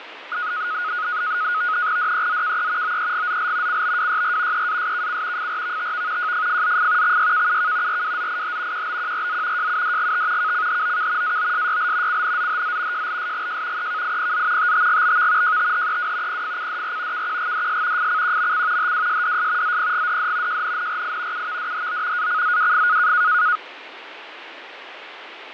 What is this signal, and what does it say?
NAVTEX (SITOR-B), 100 baud, 170 Hz shift, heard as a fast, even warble, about 1360 Hz centre, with radio static and fading. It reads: DEZKE OEGZL CBWYR EASKC FRVTV JFFZF XYKUK RWZIH QBQRZ JUDGT KCHOK AOSYL CNZHZ JLSGJ EKIPZ TTGBV JTHEW PFCDR KQGDS FCQMC HWSDS ZPGDD JNNRI UVDHO ACZWF